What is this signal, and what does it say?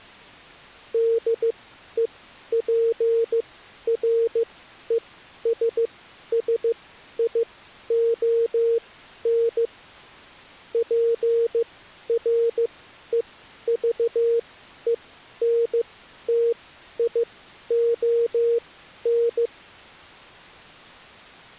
Morse code, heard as a keyed tone, machine-sent, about 15 wpm, spaced as for 11 wpm, 460 Hz. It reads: DEPRESSION PREVENTION